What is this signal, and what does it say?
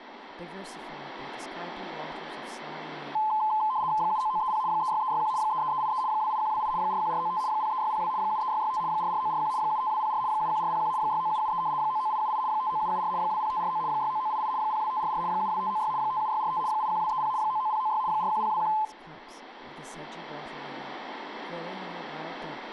RTTY (75 baud, 170 Hz shift), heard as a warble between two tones, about 950 Hz centre, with radio static and speech in English. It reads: 79930 36361 33383 28128 41495 03602 73665 44941 75204 71401 69773 99878 59774 20549 69988 02544 72596 57645 81230 99096 41021